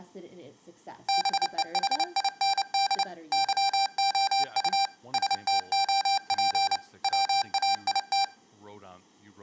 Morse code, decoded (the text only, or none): BEHIND YOU STOP WAIT